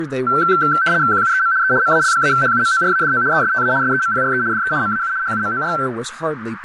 RTTY (75 baud, 170 Hz shift), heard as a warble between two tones, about 1440 Hz centre, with radio static, a narrow filter and speech in English. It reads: QUEM E MAL-HUMORADO ESTA SEMPRE DE MAU HUMOR